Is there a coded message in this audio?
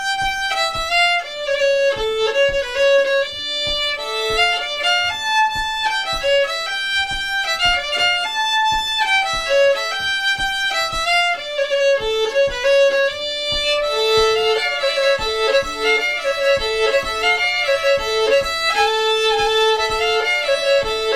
No.